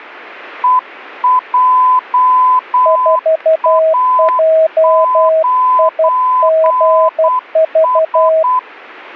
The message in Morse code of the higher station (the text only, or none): EJA9S